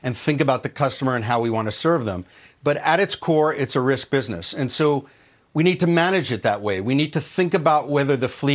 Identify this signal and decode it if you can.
Speech in English. There is no code.